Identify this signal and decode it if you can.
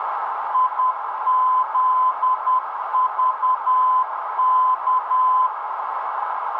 Morse code, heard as a keyed tone, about 10 wpm, 1020 Hz, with radio static and a narrow filter. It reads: IZVK